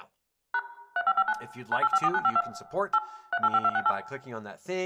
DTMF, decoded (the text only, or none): # 3559 9854952 8 385268